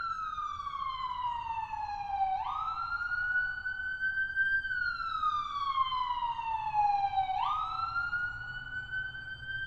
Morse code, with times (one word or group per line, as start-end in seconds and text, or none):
none